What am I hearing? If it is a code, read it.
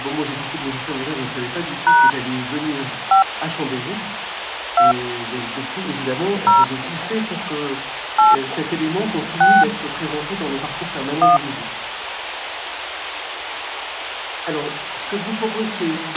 DTMF, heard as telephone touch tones, dialled by hand, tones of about 170 ms, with radio hiss and a squelch burst at the end. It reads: # 5 2 0 8 6 1